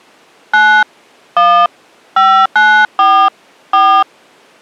DTMF, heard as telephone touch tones, dialled by hand, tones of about 300 ms. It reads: 9 1 594 4